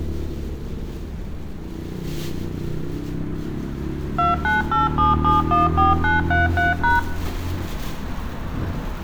DTMF, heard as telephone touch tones, dialled by machine, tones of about 160 ms, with room echo and street noise. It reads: 2987714933#